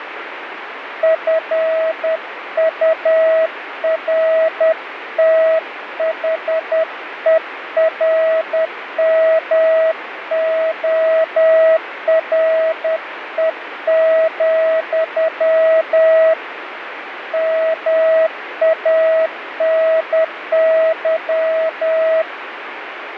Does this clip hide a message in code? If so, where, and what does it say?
Yes: Morse code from 1.0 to 22.3 s, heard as a keyed tone, hand-sent with a paddle, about 10 wpm, 640 Hz, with radio static. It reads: FURTHERMORE, MANY